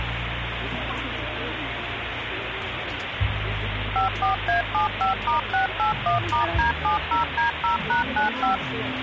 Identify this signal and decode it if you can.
DTMF, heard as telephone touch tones, dialled by machine, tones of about 130 ms, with phone line noise and the noise of a park. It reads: 54A75*681*D70D0#95